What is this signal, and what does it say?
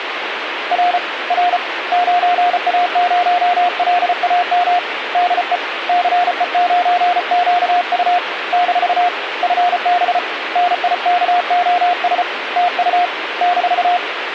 Morse code, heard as a keyed tone, hand-sent with a paddle, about 34 wpm, 710 Hz, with radio static. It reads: R R 9A0LAM DE CE9QU - FB NIKOS TU -